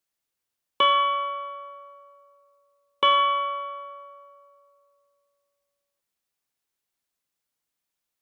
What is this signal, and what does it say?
Clock strike, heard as a bell. 2. Two o'clock.